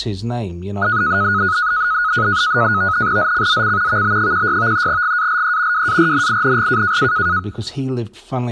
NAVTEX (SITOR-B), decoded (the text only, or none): ZCZC VB16 GALE WARNING